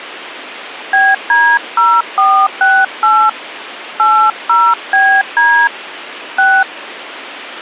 DTMF, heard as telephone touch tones, dialled by hand, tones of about 260 ms, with phone line noise. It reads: BD0468 80BD 6